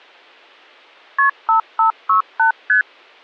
Multi-frequency trunk signalling (R1, as on North American trunks), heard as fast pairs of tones, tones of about 110 ms. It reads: KP 5568 ST